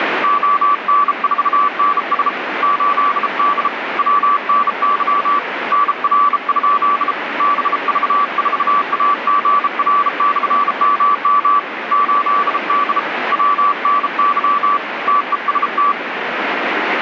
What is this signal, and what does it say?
Morse code, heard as a keyed tone, hand-sent with a bug key, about 33 wpm, 1150 Hz, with radio static. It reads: ON4NS 8D WNY NR? BV4AGR/MM 8D WNY TEST